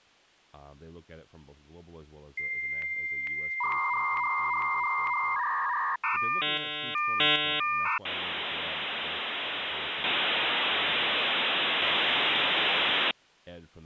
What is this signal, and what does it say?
Dial-up modem handshake (V.34 or later), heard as a whistle, warbles, then hiss, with speech in English.